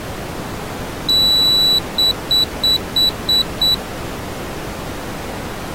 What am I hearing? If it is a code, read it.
Beep code, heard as a piezo beeper, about 3950 Hz. 1 long, 6 short.